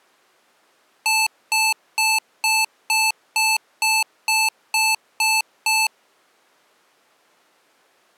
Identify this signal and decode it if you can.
Beep code, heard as beeps from a small speaker, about 880 Hz. 11 short. In AMI BIOS tables: cache memory error.